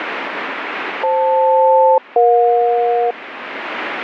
Aircraft SELCAL, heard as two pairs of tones, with radio static. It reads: FL-EJ